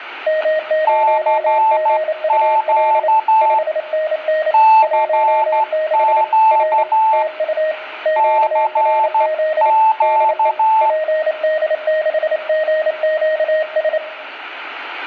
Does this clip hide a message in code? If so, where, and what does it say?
Yes: Morse code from 0.2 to 14.0 s, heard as two keyed tones, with room echo. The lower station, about 28 wpm, 620 Hz: M0GUL 5NN 16 R TU QRZ DE PD6GQS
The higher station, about 12 wpm, 880 Hz: CQ CQ CQ